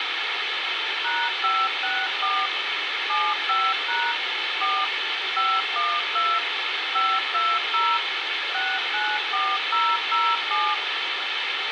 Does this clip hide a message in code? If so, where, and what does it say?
Yes: DTMF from 1.0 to 10.7 s, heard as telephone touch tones, dialled by machine, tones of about 240 ms, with radio hiss, a squelch burst at the end and room echo. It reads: #564 75# 4 512 520 694007